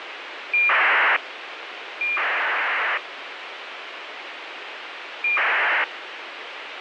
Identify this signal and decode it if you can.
ACARS aircraft data, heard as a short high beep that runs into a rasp, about 2400 baud, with radio hiss.